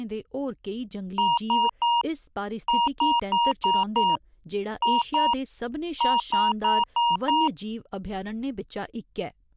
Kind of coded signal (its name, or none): beep code